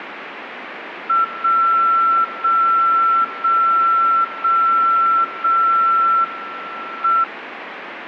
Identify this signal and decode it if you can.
Radio time signal (WWVB), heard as a tone whose level steps once a second, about 1350 Hz, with radio static. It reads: 0 0 0 0 0 M